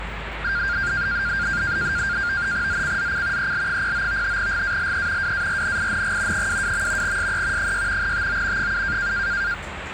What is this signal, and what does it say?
NAVTEX (SITOR-B), 100 baud, 170 Hz shift, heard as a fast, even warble, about 1500 Hz centre, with radio static and the noise inside a bus. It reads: ZCZC EL09 GALE WARNING 22. SE 6 TO 7